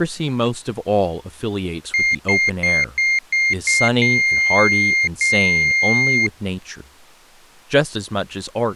Beep code, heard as a piezo beeper, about 2100 Hz, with speech in English. 6 short, 2 long.